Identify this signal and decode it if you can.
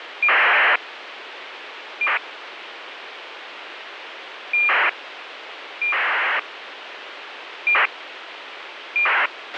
ACARS aircraft data, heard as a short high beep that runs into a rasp, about 2400 baud, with radio hiss and a squelch burst at the end.